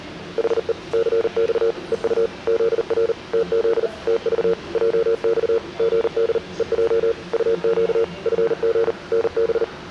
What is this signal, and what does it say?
Morse code, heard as a keyed tone, machine-sent, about 39 wpm, 460 Hz, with the noise inside a lift. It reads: HE CX EU ZR TZ TV JX GD EJ UQ FG NB